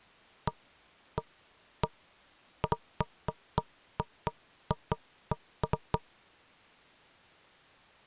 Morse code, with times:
none

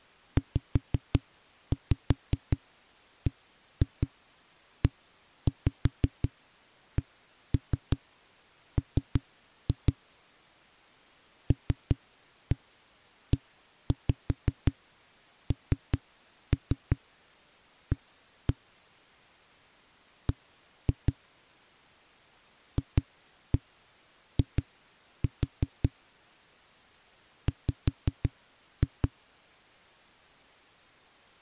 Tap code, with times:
0.4-9.9 ZBECM
11.5-18.5 LENA
20.3-21.1 B
22.8-25.9 FI
27.5-29.1 W

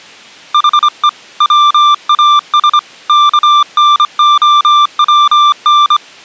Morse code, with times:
0.5-1.1 HE
1.4-2.8 WAS
3.1-6.0 KNOWN

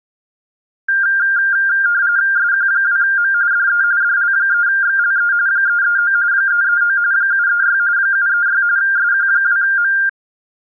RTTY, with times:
2.4-3.3 SQ2M
3.5-3.8 DE
4.0-5.3 DL3XLE
5.5-6.1 339
6.3-7.0 339
7.1-7.8 736
8.0-8.6 736
8.8-9.9 SQ2M

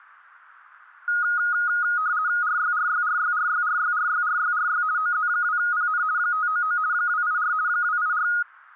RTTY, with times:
2.4-4.8 RYRYRYRYRYRYRYRY
5.0-6.0 OZ2PN
6.2-6.8 599
6.9-7.5 284
7.7-8.3 284

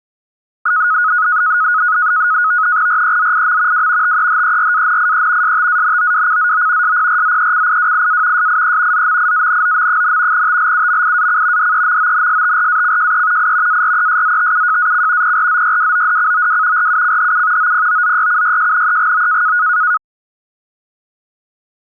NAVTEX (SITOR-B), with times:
2.9-3.9 REZIM
3.7-4.2 W
4.0-5.6 TEHERANIE
5.4-7.0 STANOWCZO
6.8-8.5 SPRZECIWIA
8.4-9.1 SIE
8.9-10.5 ZMIANOM,
10.3-11.7 TLUMIAC
11.6-13.5 DEMONSTRACJE
13.4-13.8 I
13.7-15.4 ARESZTUJAC
15.2-16.9 PRZYWODCOW
16.8-17.7 RUCHU
17.6-19.6 OPOZYCYJNEGO

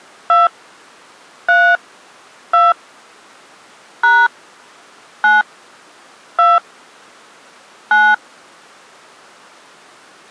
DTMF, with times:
0.3-0.5 2
1.5-1.8 3
2.5-2.7 2
4.0-4.3 #
5.2-5.4 9
6.4-6.6 2
7.9-8.1 9

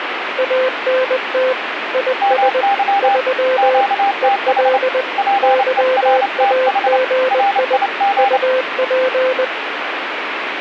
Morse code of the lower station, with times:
0.4-1.5 ANT
1.9-2.6 IS
3.0-3.8 3
4.2-5.0 EL
5.4-7.8 YAGI
8.2-9.4 UP

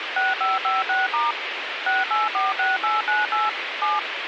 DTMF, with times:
0.2-1.3 6556*
1.9-3.5 6846898
3.8-4.0 7

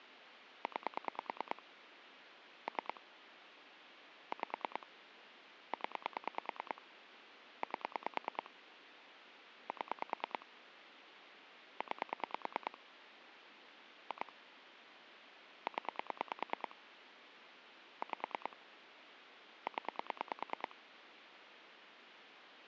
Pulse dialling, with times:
0.6-1.6 9
2.7-3.0 3
4.3-4.9 5
5.7-6.8 0
7.6-8.5 8
9.7-10.5 7
11.8-12.8 9
14.1-14.3 2
15.7-16.7 0
18.0-18.6 5
19.7-20.7 0

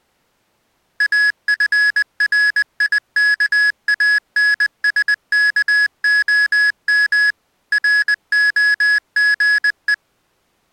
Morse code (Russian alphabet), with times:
1.0-7.3 АФРИКАНСКОМ
7.7-9.9 РОГЕ

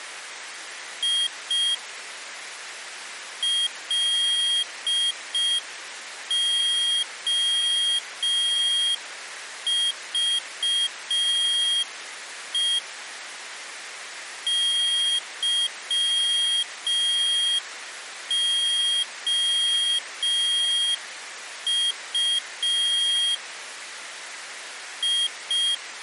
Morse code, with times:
1.0-1.7 I
3.4-12.8 LOVE
14.5-23.3 YOU
25.0-25.7 I

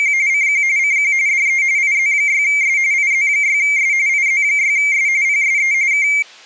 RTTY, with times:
0.0-0.1 …
0.3-0.6 CQ
0.8-1.1 CQ
1.3-1.6 DE
1.8-2.8 IZ6S
2.9-3.9 IZ6S
4.1-5.1 IZ6S
5.2-5.7 PSE
5.9-6.1 K

